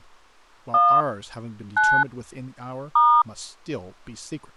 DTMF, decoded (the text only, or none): 1 9 *